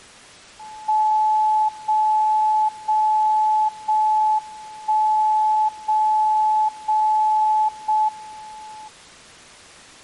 Radio time signal (JJY), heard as a tone whose level steps once a second, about 860 Hz. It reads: 0 0 0 1 0 0 0 M